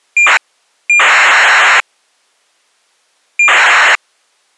ACARS aircraft data, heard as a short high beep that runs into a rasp, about 2400 baud.